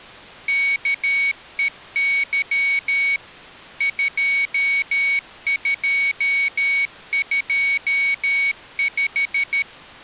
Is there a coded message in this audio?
Yes: Morse code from 0.4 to 9.7 s, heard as a high beeper, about 13 wpm, 2250 Hz. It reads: KEY 2225